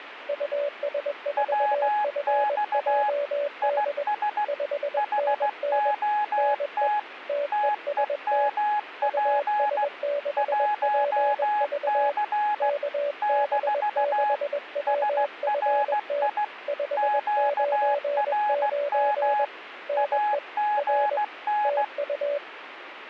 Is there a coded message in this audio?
Yes: Morse code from 0.2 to 22.4 s, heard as two keyed tones, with radio static. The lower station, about 21 wpm, 580 Hz: US4FJD 5NN NE TEST US6PV KB6WFT 599 NE R TU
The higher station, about 16 wpm, 840 Hz: WX IS HOT TEMP 1C - SRI QRM AGN